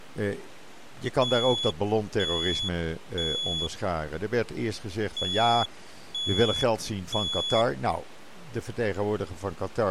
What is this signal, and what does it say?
Alarm pattern, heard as an alarm's beeps, played twice, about 3400 Hz, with speech in Dutch. Temporal three. Smoke or fire, evacuate.